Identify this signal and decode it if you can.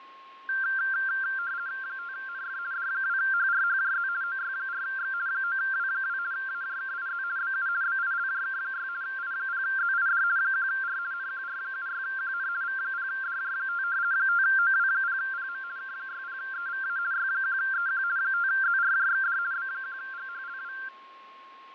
RTTY (50 baud, 170 Hz shift), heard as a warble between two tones, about 1480 Hz centre, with fading and a steady whistle near 1080 Hz. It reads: 5NF D2HRHJZ OY4X 9W2 AJKIZ BU BILJK6 I0ZID 1R NQR76QN V0DJ5 5OW0PM K60EVA Y1EQ 5ZRJXD B1GHLW